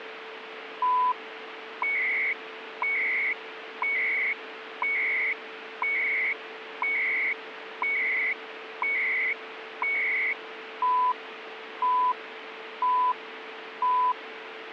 Radio time signal (CHU, Canada), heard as beeps and data bursts, one a second, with radio static.